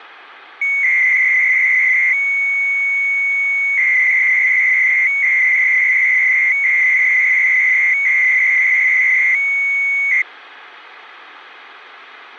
300-baud modem data (Bell 103 tones), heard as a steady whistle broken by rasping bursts, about 300 baud, 200 Hz shift.